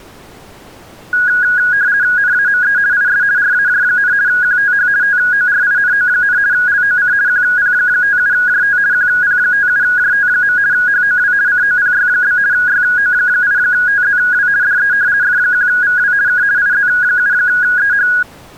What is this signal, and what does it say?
RTTY (50 baud, 170 Hz shift), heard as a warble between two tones, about 1550 Hz centre. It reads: NAME IS RAJ, QTH TORINO, LOC QP57JT QP57JT. HOW COPY? YO8TZW DE F1VW K IZ7EH